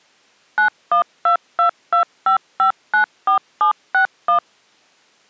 DTMF, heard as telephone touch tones, dialled by machine, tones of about 110 ms. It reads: 912225594761